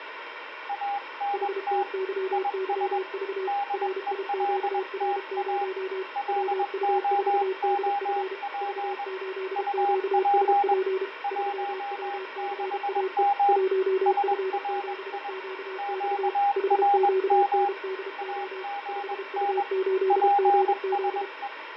Morse code, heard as two keyed tones, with radio static and fading. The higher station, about 21 wpm, 810 Hz: ANT IS DELTA LOOP UP 16M SRI QRM AGN PSE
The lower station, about 32 wpm, 380 Hz: HTYYV RIQR0 WU4DF V8QSP 3WCAE 1F7QX HQNDO 5U8GZ